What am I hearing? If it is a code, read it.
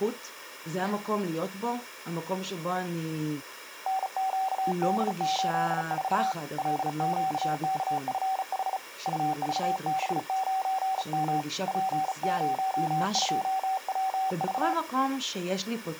Morse code, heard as a keyed tone, hand-sent with a bug key, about 35 wpm, 760 Hz, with speech in Hebrew. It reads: NQD84 LQKFH UVB9M P02WV